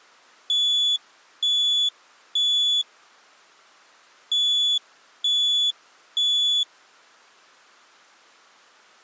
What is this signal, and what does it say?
Alarm pattern, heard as an alarm's beeps, played twice, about 3450 Hz. Temporal three. Smoke or fire, evacuate.